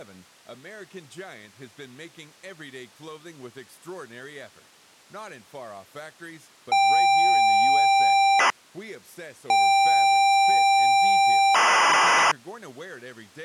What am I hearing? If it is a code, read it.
ZX Spectrum tape loading, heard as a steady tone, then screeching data.